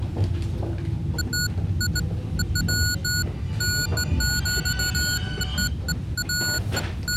Beeps of irregular length, with the noise inside a subway train. There is no code.